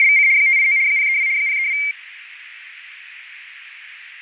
RTTY (75 baud, 170 Hz shift), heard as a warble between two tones, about 2200 Hz centre, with radio static and fading. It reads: … 589 032 032